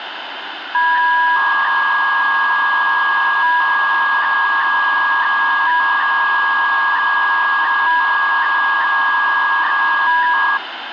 300-baud modem data (V.21 tones), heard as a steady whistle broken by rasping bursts, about 300 baud, 200 Hz shift, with phone line noise.